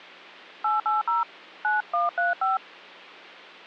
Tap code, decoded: none

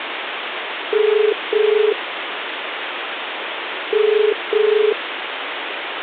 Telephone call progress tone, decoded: ringback tone

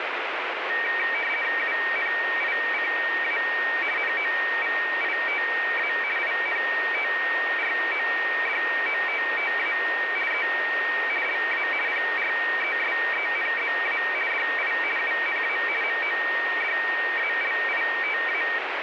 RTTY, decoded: UNICA NOVITA INTRODOTTA E LA PRESENZA DI UNA MODALITA

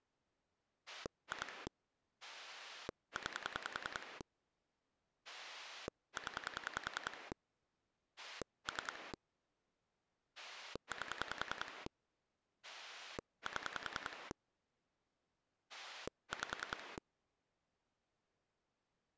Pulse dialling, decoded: 2 9 0 3 8 7 5

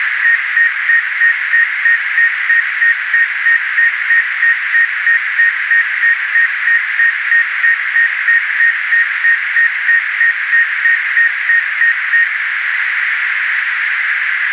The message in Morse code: none

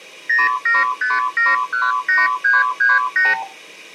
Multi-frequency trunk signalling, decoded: 075718338

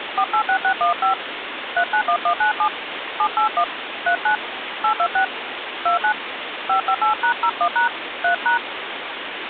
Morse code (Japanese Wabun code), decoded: none

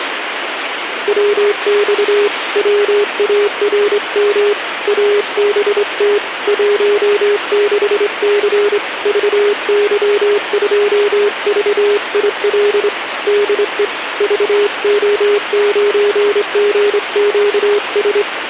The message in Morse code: WX WARM ABT 16C VY2VIL DE VO9GQS

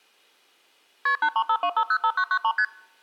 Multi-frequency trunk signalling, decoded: KP 8352505993 ST

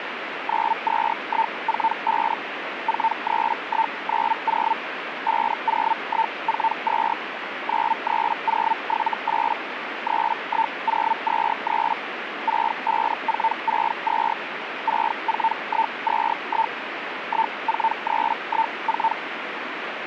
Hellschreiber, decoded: 92145 43190 50142 93078 31023 65462 64121 14314

